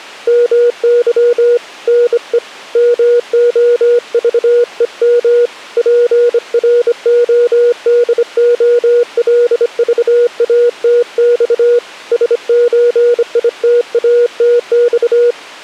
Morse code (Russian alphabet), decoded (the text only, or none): МЫ НЕ МОЖЕМ ПРОДОЛЖАТЬ СЧИТАТЬ